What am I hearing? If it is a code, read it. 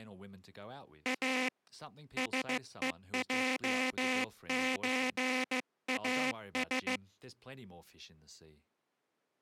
Morse code (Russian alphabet), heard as a buzzer, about 15 wpm, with speech in English. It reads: А СЕЙЧАС